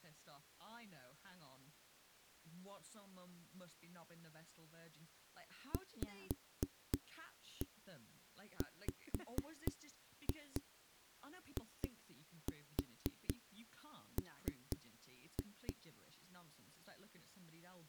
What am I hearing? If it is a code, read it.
Tap code, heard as knocks on a wall, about 4 knocks a second, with speech in English. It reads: VWIM